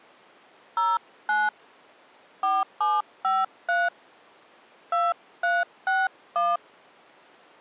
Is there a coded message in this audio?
Yes: DTMF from 0.8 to 6.6 s, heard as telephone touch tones, dialled by hand, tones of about 200 ms. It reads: 09 4753 2361